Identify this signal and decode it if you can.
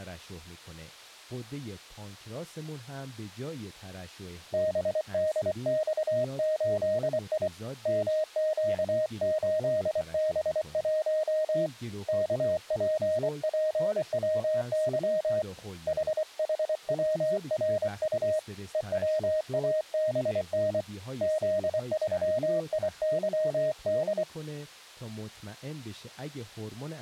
Morse code, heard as a keyed tone, hand-sent with a paddle, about 24 wpm, 620 Hz, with speech in Persian. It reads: BDX8I MQ8B1 KPPWY HHWRU EWABN Z3IYD